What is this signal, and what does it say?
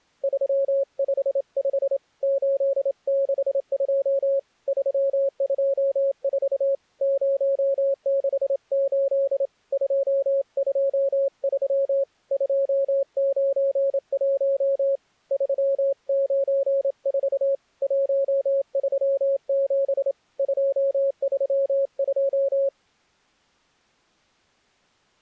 Morse code, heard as a keyed tone, hand-sent with a straight key, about 27 wpm, 550 Hz. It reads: 355 862 324 068 223 291 394 137 232